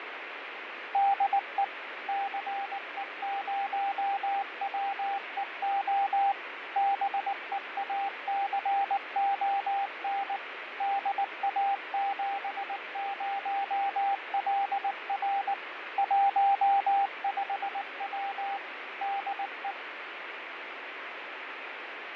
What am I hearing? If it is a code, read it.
Morse code, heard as a keyed tone, machine-sent, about 19 wpm, 790 Hz, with radio static and fading. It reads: DE CE0WEO BEACON DA70LR 15W DE